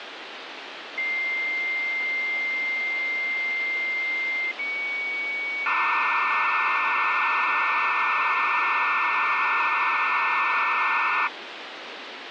Dial-up modem handshake (low-speed, two carriers), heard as two whistles, then hiss, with phone line noise.